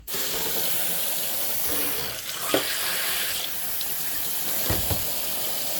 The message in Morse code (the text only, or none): none